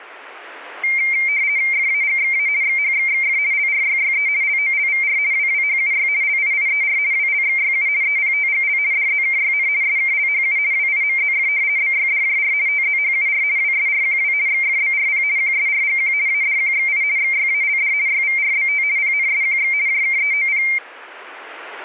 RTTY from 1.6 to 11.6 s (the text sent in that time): FAGXA XHXXF LRYYE LOLVR WWHUY LIIER WLXYU EPTGL DZKYN SKLHU WIMZF